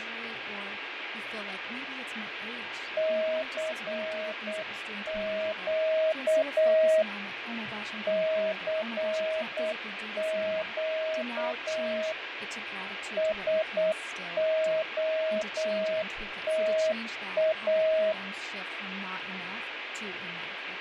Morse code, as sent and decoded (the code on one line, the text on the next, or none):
-.-. --.- / -.-. --.- / ... --- - .-
CQ CQ SOTA